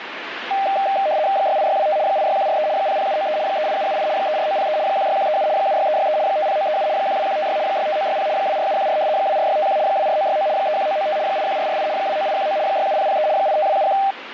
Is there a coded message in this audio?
Yes: RTTY (75 baud, 170 Hz shift) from 0.5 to 14.1 s, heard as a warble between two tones, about 700 Hz centre, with radio static. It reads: 68625 86143 00793 38778 34903 16137 76363 50937 12156 65960 24714 24651 24969 31995 81448 29819 67003 85271